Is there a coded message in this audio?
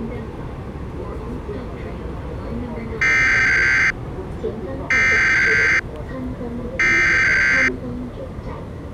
Yes: Emergency Alert System (SAME) tones (header bursts) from 3.0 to 7.7 s, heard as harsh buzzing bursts, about 520.83 baud, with the noise inside a subway train.